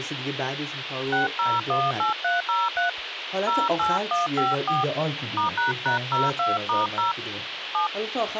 DTMF, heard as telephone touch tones, dialled by hand, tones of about 160 ms, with radio hiss and speech in Persian. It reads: 6018303 08154 *##02*0 7